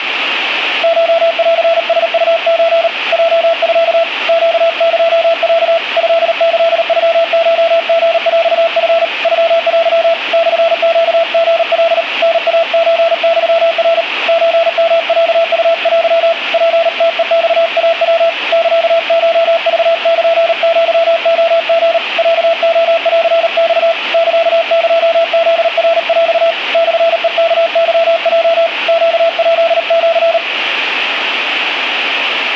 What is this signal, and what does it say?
Morse code (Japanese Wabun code), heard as a keyed tone, hand-sent with a paddle, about 38 wpm, 670 Hz, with radio static. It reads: コンラウソ ヲミ ネエロ トキノコリヰチ ノテ モネリカ タイソユナ ソヨロウテ ツムヘマイヤ サコクルアレリ ロレンマ サエフナヰ モヘワケヲ ネヱシ